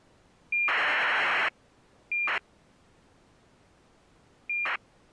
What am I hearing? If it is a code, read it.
ACARS aircraft data, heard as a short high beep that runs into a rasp, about 2400 baud.